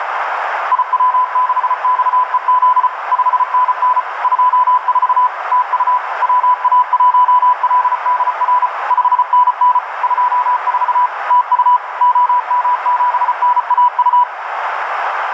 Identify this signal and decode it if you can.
Morse code, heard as a keyed tone, machine-sent, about 34 wpm, 1000 Hz, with radio static, a narrow filter and room echo. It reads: IW6XEZ 5NN 24 TU WA1LDR 5NN 24 TU OM7NAU